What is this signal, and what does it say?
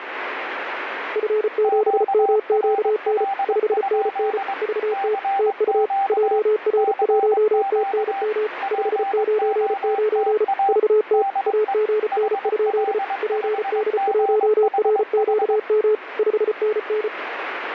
Morse code, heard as two keyed tones, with radio static. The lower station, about 34 wpm, 430 Hz: F7MQN 5NN VT TU JR1TNM 599 VT AGN? PD1RQM 5NN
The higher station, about 22 wpm, 790 Hz: QRL? CQ CQ POTA DE HL5GHH